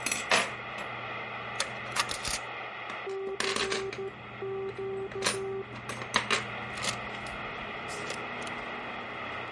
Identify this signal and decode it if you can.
Morse code, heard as a keyed tone, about 13 wpm, 390 Hz, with radio static and kitchen noise. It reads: CQ